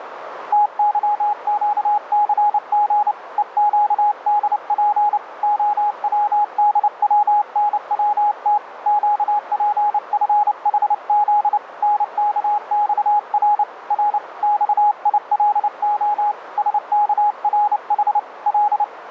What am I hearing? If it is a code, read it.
Morse code, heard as a keyed tone, hand-sent with a bug key, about 29 wpm, 830 Hz, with radio static and a narrow filter. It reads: TYQCG EQDP OWDWNWT QPFHZ NKXR R XILO SKRH L